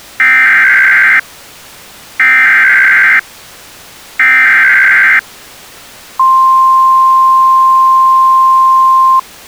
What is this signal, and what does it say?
Emergency Alert System (SAME) tones (header bursts, then the 1050 Hz attention tone), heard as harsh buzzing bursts, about 520.83 baud.